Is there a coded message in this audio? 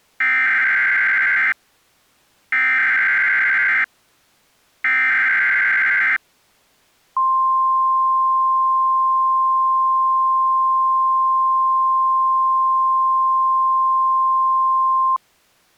Yes: Emergency Alert System (SAME) tones (header bursts, then the 1050 Hz attention tone) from 0.2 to 15.2 s, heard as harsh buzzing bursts, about 520.83 baud.